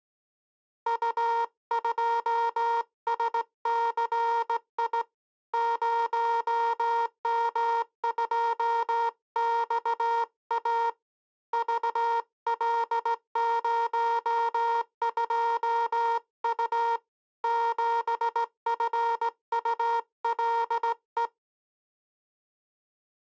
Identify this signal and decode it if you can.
Morse code, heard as a buzzer, hand-sent with a straight key, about 17 wpm. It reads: U2SCI 0M2XA VL02U 7FULE